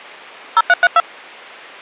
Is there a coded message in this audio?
Yes: DTMF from 0.6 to 1.0 s, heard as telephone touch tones, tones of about 40 ms. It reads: 0332